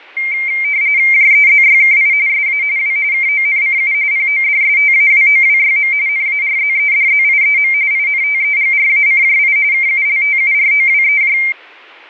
RTTY (45.45 baud, 170 Hz shift), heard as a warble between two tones, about 2200 Hz centre, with fading. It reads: JEZYKI SA W KONCU PODSTAWOWYM NARZEDZIEM INTEGRACJI KULTUROWEJ